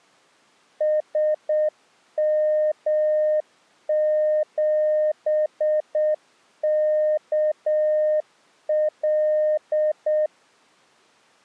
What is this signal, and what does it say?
Morse code, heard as a keyed tone, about 7 wpm, 610 Hz. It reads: SM7KL